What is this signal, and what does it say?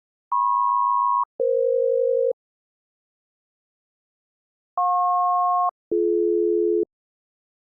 Aircraft SELCAL, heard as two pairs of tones. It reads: MP-EF JP-BD